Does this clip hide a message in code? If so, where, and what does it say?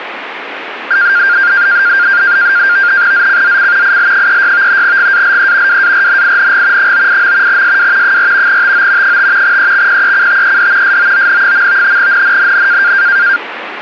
Yes: NAVTEX (SITOR-B), 100 baud, 170 Hz shift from 0.9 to 13.4 s, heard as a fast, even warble, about 1500 Hz centre, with radio static. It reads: ZCZC IL36 GALE WARNING 98. SW 4 TO 5 EXPECTED SOON. NNNN